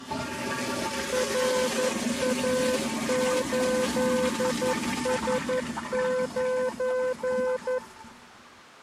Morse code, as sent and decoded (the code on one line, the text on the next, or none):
.-. .- ---.. ... ----.
RA8S9